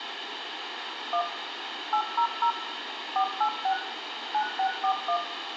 DTMF, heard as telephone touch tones, dialled by machine, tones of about 80 ms, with phone line noise and room echo. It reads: 1 800 486 9641